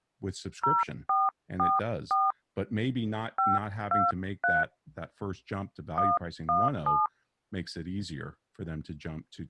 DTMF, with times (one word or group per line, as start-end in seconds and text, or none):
0.6-2.3 0444
3.4-4.6 523
6.0-7.1 117